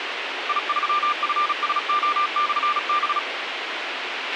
Morse code, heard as a keyed tone, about 36 wpm, 1190 Hz, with radio hiss and a squelch burst at the end. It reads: I3FSO/B